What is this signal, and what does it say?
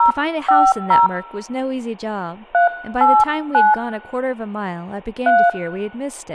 DTMF, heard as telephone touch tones, dialled by hand, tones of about 170 ms, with speech in English. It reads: 050 389 3